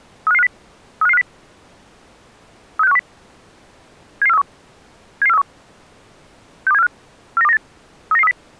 Five-tone selective call (EEA), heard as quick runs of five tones, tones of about 40 ms. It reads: 35550 35550 36510 77431 77431 62745 49298 39930